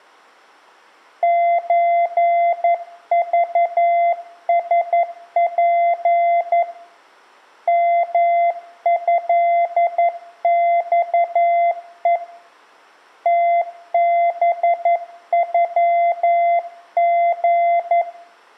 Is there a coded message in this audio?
Yes: Morse code (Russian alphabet) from 1.2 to 18.1 s, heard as a keyed tone, hand-sent with a paddle, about 11 wpm, 690 Hz, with room echo. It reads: ЧЖСП МЭЬЕ ТБЮГ